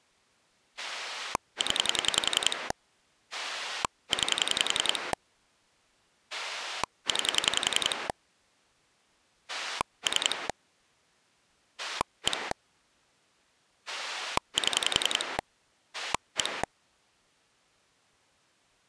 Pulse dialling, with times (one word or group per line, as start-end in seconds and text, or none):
0.8-2.7 0
3.3-5.1 9
6.3-8.1 9
9.5-10.5 3
11.8-12.5 1
13.9-15.4 7
15.9-16.6 1